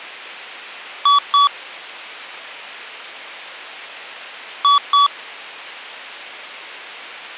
Beep code, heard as beeps from a small speaker, played twice, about 1140 Hz. 2 short. In AMI BIOS tables: memory parity error; in IBM BIOS tables: self-test error shown on screen; in Dell tables: no memory detected.